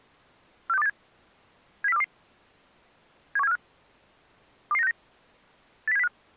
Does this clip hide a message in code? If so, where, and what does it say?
Yes: five-tone selective call (EEA) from 0.7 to 6.1 s, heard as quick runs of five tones, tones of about 40 ms. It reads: 46287 70422 71745 22969 80705